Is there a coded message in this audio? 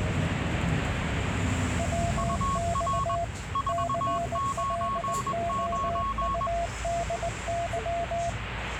Yes: Morse code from 1.7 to 8.4 s, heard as two keyed tones, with radio static and the noise inside a bus. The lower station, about 19 wpm, 680 Hz: WX CLOUDY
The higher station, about 21 wpm, 1100 Hz: UR 499